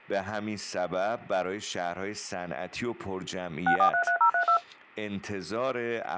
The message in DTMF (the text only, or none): 6433032